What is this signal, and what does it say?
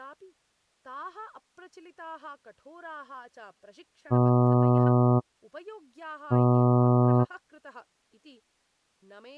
Ship horn signal, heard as a ship's horn, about 120 Hz, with speech in Sanskrit. 2 short. At sea: I am altering course to port.